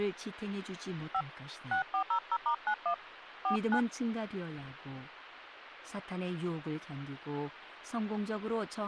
DTMF, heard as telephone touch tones, dialled by hand, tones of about 80 ms, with speech in Korean. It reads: 5 6400*91 49